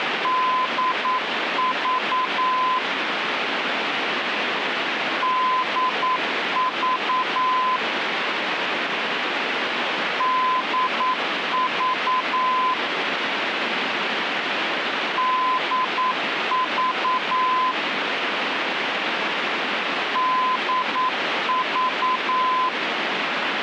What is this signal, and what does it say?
Morse code, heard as a keyed tone, machine-sent, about 9 wpm, 1020 Hz, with radio static. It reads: DV DV DV DV DV